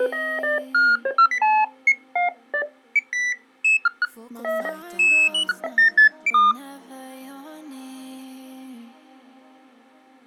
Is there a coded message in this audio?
No, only electronic bleeps of random pitch and length.